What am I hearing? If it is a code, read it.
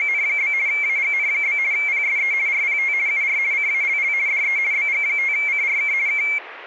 RTTY (50 baud, 170 Hz shift), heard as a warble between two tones, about 2250 Hz centre, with radio static. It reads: … AGN? PSE RPT UR CALL DE BG5CRK K